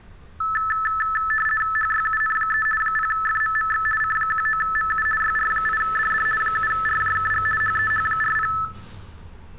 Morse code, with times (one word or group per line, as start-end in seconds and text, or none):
none